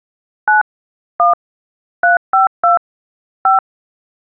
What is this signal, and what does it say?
DTMF, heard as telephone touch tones, dialled by hand, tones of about 140 ms. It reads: 9 1 352 5